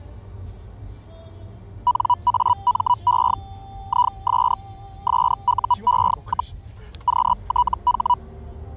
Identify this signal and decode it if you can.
Hellschreiber (Feld-Hell, 122.5 baud), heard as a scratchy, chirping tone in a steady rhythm, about 980 Hz, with the noise inside a car. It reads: NAME IS SUE, QTH